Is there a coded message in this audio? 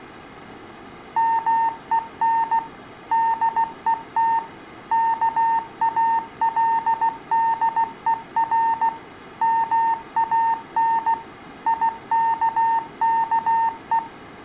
Yes: Morse code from 1.1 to 14.0 s, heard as a keyed tone, machine-sent, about 16 wpm, 910 Hz, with room echo. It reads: MEN DET KALDER MAN IKKE